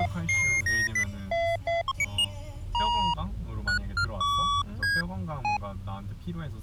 Electronic bleeps of random pitch and length, with the noise inside a car. There is no code.